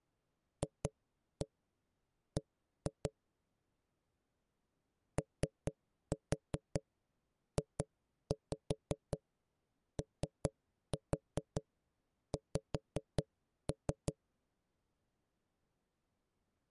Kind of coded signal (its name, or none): tap code